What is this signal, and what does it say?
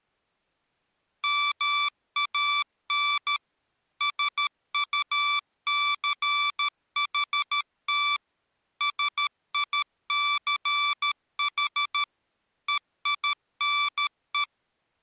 Morse code, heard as electronic beeps, machine-sent, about 13 wpm, 1160 Hz. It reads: MAN SUCHT SICH EINE